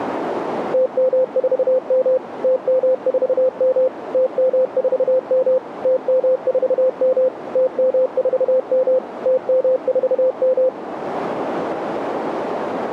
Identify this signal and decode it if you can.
Morse code, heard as a keyed tone, machine-sent, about 31 wpm, 520 Hz, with radio static and a narrow filter. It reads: TM4M TM4M TM4M TM4M TM4M TM4M